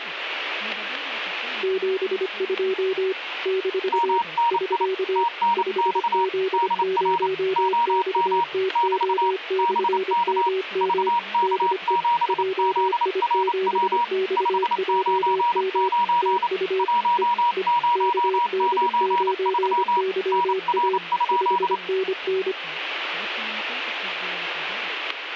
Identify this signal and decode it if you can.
Morse code, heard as two keyed tones, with radio static and static crashes. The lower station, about 25 wpm, 380 Hz: 72 - <SK> 5Z0XTO/MM DE JI7XJM TU E E KD9YA 5NN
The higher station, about 28 wpm, 950 Hz: MNI TNX DR OM <BT> BK VK7ZRW 599 1093 NR?